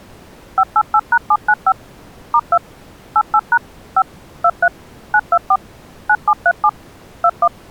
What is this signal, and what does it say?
DTMF, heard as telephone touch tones, dialled by machine, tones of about 60 ms. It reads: 588#795 *2 88# 5 23 924 9737 21